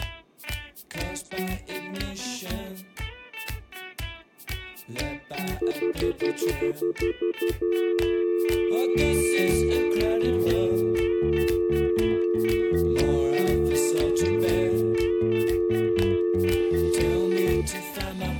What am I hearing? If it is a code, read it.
Telephone call progress tone (North American plan), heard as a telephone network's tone, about 350, 440 Hz, 0.1 s on and 0.1 s off, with room echo. Stutter dial tone.